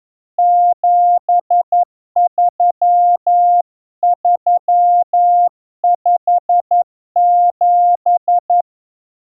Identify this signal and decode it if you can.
Morse code, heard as a keyed tone, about 11 wpm, 700 Hz. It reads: 73357